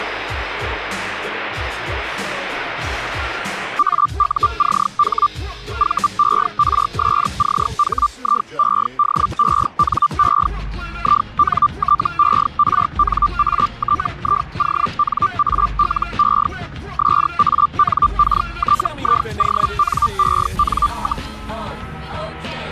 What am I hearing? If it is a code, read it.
Hellschreiber (Feld-Hell, 122.5 baud), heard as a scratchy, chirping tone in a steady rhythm, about 1180 Hz. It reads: AUCH VERSCHIEDENE INTERNATIONALE SANKTIONEN,